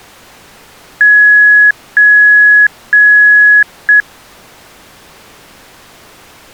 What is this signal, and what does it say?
Beep code, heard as beeps, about 1700 Hz. 3 long, 1 short.